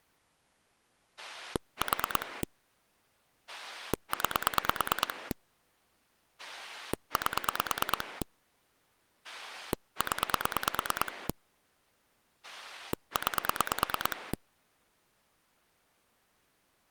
Pulse dialling, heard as a rotary dial, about 9 pulses a second. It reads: 4 9 8 0 9